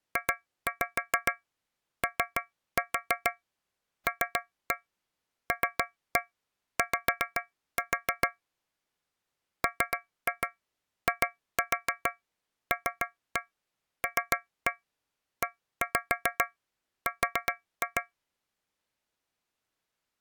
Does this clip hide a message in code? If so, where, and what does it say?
Yes: tap code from 0.2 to 18.1 s, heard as taps on a metal pipe, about 7 knocks a second. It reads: JOLLY MILLER